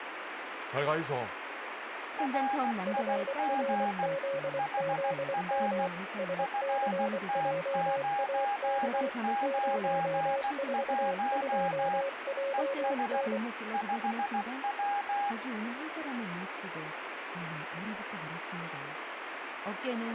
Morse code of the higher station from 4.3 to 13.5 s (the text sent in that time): HR FT991 ES